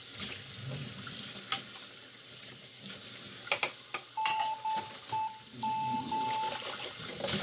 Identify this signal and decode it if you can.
Morse code, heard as a keyed tone, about 11 wpm, 880 Hz, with room echo and kitchen noise. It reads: NEM